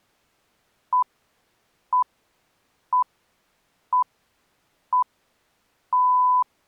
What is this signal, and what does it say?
Radio time signal (six pips, as the Greenwich Time Signal), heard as pips.